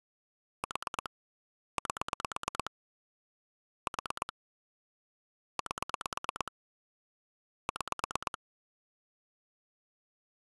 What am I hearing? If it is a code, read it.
Pulse dialling, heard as clicks on a phone line, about 9 pulses a second. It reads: 4 8 4 8 6